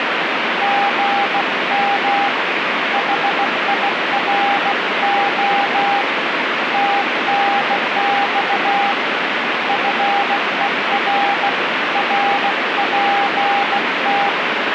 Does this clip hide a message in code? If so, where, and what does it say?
Yes: Morse code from 0.6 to 14.4 s, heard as a keyed tone, hand-sent with a bug key, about 16 wpm, 800 Hz, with heavy radio static. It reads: GM HIRO TNX FER RPT